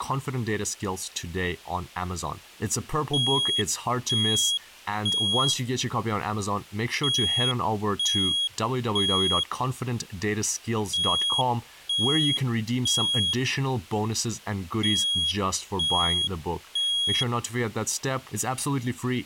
Alarm pattern, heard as an alarm's beeps, played four times, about 3300 Hz, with speech in English. Temporal three. Smoke or fire, evacuate.